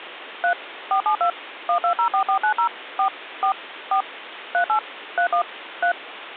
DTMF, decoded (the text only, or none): 3 472 1204490 4 4 4 38 31 3